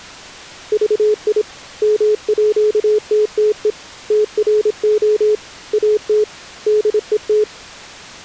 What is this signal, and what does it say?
Morse code (with Danish letters), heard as a keyed tone, hand-sent with a paddle, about 26 wpm, 420 Hz. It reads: VI MÅTTE TRO AT DET